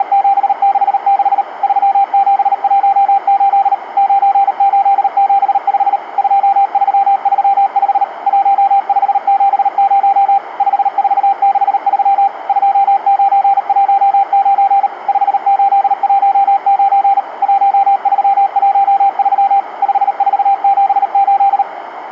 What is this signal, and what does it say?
Morse code, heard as a keyed tone, machine-sent, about 38 wpm, 790 Hz, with radio static and a narrow filter. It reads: … 3718 9875 2335 1570 5463 2919 5819 1313 5478